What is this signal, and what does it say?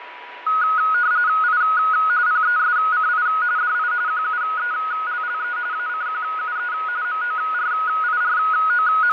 RTTY (45.45 baud, 170 Hz shift), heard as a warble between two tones, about 1360 Hz centre, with radio static, fading and a steady whistle near 980 Hz. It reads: I PESCI DI QUELLE ACQUE …